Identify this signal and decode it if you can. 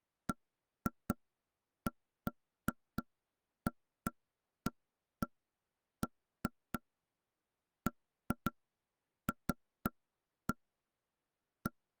Irregular knocks on wood. There is no code.